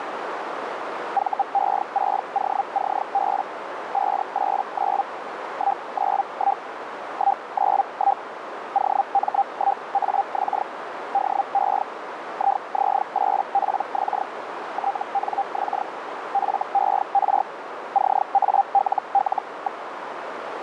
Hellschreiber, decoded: VE6OCB 589 191 191 OM1AX DE IZ8PX TNX FER CALL.

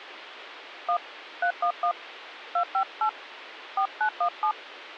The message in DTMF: 1 311 258 4917

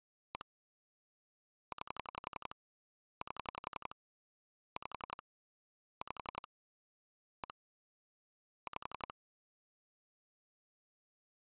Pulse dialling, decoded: 1 9 8 5 5 1 5

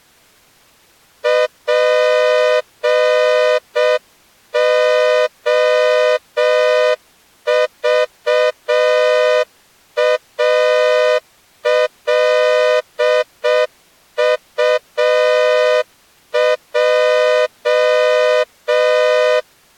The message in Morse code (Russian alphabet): ПОЖАЛУЙ

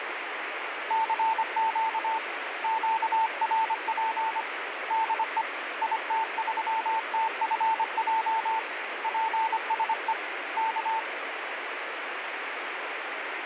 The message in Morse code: CQ QRP DE IT3TFJ PSE K

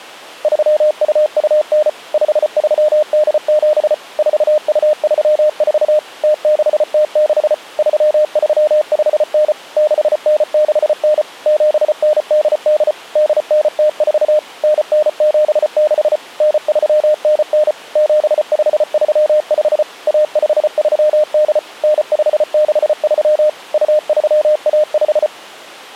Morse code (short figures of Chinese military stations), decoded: 3229 5387 4234 0606 3359 6969 7988 8904 9976 9399 7535 1538 9563 2315

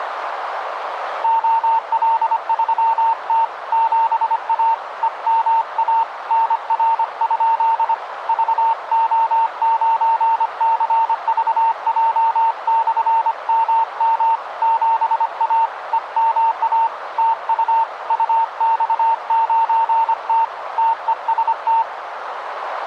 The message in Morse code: OL3T 7A EMA NR? VO9CVJ/MM 7A EMA TU UX9T TEST

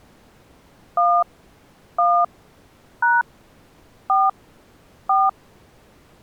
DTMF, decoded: 1 1 # 4 4

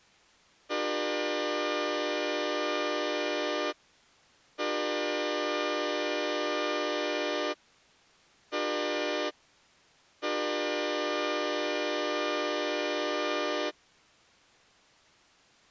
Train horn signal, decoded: 2 long, 1 short, 1 long

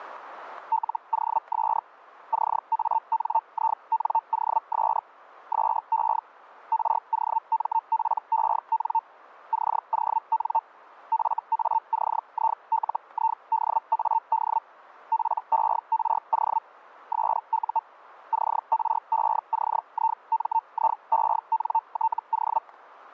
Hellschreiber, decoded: LOS CANINOS SE ROMPEN CON FACILIDAD PERO SU CRECIMIENTO

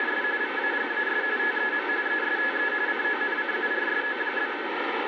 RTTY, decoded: … VAGAS TEM ESTE CONCURSO?

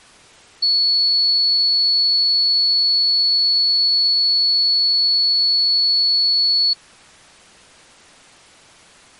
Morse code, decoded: none

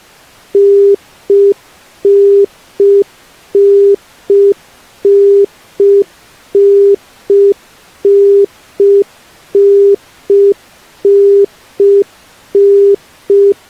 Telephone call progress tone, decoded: congestion tone

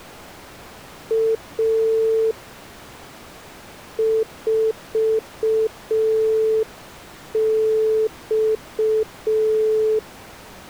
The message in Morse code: A 4X

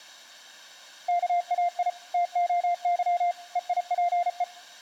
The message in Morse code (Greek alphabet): ΚΑΙ ΤΟΥ ΕΙΠΕ

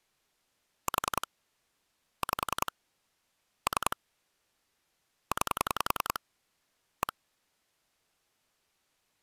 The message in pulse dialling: 4 5 3 9 1

